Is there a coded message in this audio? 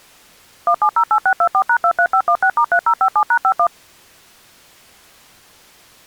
Yes: DTMF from 0.7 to 3.7 s, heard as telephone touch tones, dialled by machine, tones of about 70 ms. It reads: 1708624#23516*3057#51